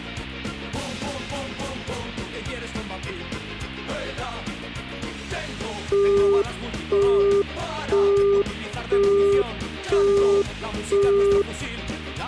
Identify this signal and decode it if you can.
Telephone call progress tone (single-tone plan, as in Europe, Japan and elsewhere), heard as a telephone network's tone, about 400 Hz, 0.5 s on and 0.5 s off. Busy tone.